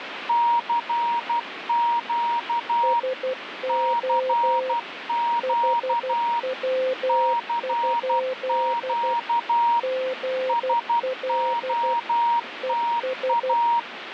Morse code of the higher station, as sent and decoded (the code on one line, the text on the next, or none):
-.-. --.- / -.-. --.- / -.-. --.- / ... --- - .-
CQ CQ CQ SOTA